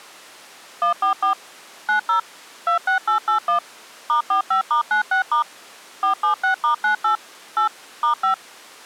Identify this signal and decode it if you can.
DTMF, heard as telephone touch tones, dialled by machine, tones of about 110 ms. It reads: 144 90 26881 *45*96* 476*98 8 *5